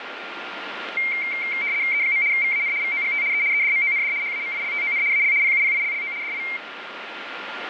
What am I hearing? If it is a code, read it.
RTTY (75 baud, 170 Hz shift), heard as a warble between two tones, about 2200 Hz centre, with radio static and a steady whistle near 1400 Hz. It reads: E. VAN VOGT E EDMOND HAMILTON AL PUPILLO DI